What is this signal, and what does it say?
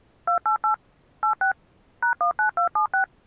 DTMF, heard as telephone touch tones, dialled by machine, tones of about 100 ms. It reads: 288 86 #19276